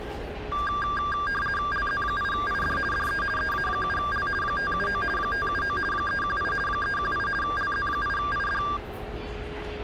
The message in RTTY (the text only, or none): LZ8ID DE EA7L 579 579 318 318 LZ8ID